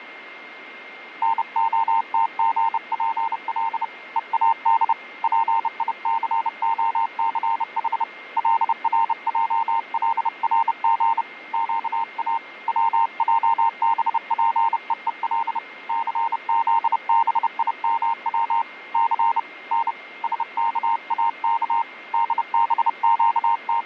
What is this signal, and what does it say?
Morse code (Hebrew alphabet), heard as a keyed tone, hand-sent with a bug key, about 30 wpm, 920 Hz, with a steady whistle near 2120 Hz. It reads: נהתגפל ואד פיסהסח לרעלרג קא צעבפוול סזבימץ ס נ שכאך …